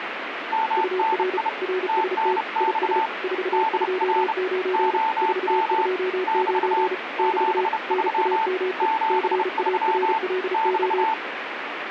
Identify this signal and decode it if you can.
Morse code, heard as two keyed tones, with radio static. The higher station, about 30 wpm, 890 Hz: MNI TNX DR OM <BT> 73 73 <BT>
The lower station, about 34 wpm, 370 Hz: UR RST IS 429 429 <BT> NAME CARLO